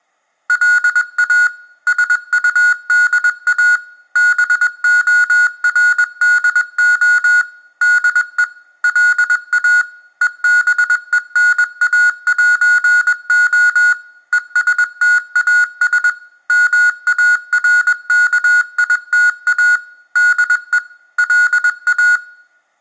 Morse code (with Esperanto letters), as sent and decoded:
.-.. .- / ... ..- -.. .- / -... --- .-. -.. --- / -.. . / .-.. .- / . -... . -. .- .---. --- / . ... - .- ... / -- .- .-. -.- .. - .- / -.. . / .-.. .-
LA SUDA BORDO DE LA EBENAĴO ESTAS MARKITA DE LA

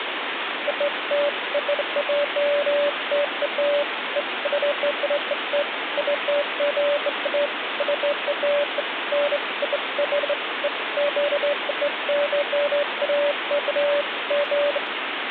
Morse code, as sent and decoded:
none

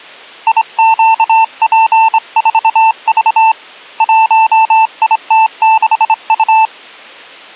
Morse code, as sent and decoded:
.. --.- .--. ....- ...- / .---- .. - -.... ..-
IQP4V 1IT6U

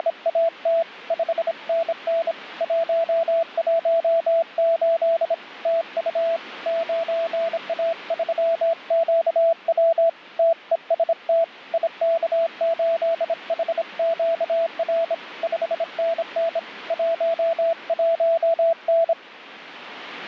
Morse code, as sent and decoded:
… / ..... -. -. / .---- .---- ---.. / - ..- / ----. .- ...-- --.- .-- / - . ... - / .. -.- ---.. .... --.- .-. / ..... -. -. / .---- .---- -.
… 5NN 118 TU 9A3QW TEST IK8HQR 5NN 11N

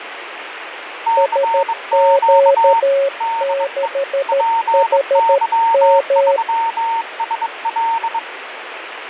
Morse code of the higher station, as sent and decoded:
-.-. --.- / -.. . / .--. -.-- ...-- ... .-..
CQ DE PY3SL

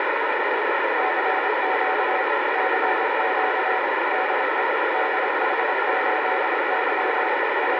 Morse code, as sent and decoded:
-.-. --.- / -.-. --.- / -.. . / -.. .... ---.. -.-- / …
CQ CQ DE DH8Y …

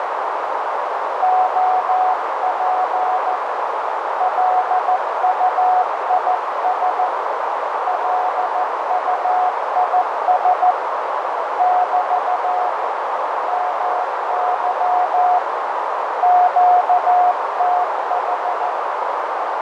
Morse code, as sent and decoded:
--- .--. / .-.. ..- .. ... / .-.. ..- .. ... / -...- / -- -.-- / --.- - ....
OP LUIS LUIS <BT> MY QTH

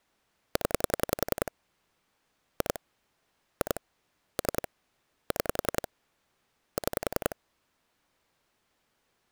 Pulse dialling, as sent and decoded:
10 / 2 / 2 / 3 / 6 / 6
0 2 2 3 6 6

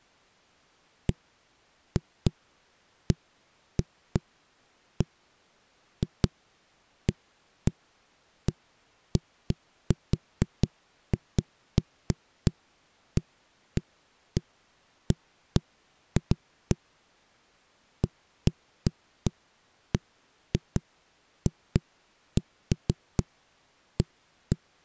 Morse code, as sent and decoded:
none

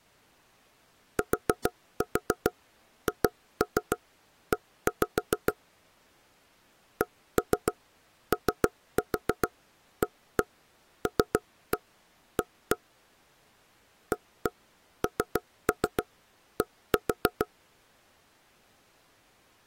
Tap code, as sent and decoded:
4-4 2-3 1-5 / 1-3 3-4 1-1 3-1 1-1 / 1-1 3-3 1-4
THE KOALA AND

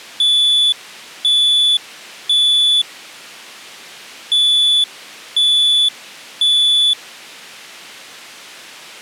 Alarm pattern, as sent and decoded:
3 beeps and a pause
temporal three

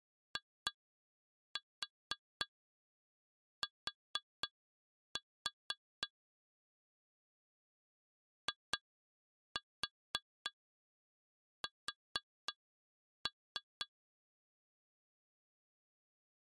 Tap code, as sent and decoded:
2-4 4-4 / 2-4 4-3
IT IS

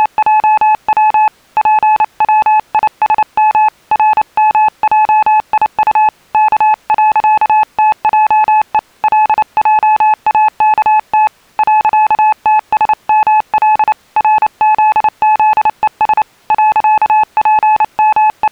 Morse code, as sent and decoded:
… / .--. .-- .. ... -- / .-. -- .--- .. ..- / -.- .-.-.- - .--- . / .-.. .--- .- -.- - / .-.-.- - ... -- .-.. / .-. --.. --.. . ... / …
… PWISM RMJIU K.TJE LJAKT .TSML RZZES …

